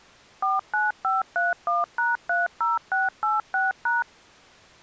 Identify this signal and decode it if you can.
DTMF, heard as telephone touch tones, dialled by machine, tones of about 170 ms. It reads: 49531#30686#